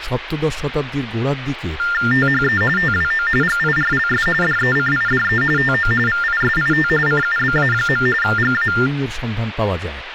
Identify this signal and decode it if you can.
TTY/TDD text telephone tones (45.45 baud Baudot), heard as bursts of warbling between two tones, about 400 Hz shift, 1600 Hz centre, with phone line noise and speech in Bangla. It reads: THE TWO GIRLS DECIDE TO VISIT CUBA. GA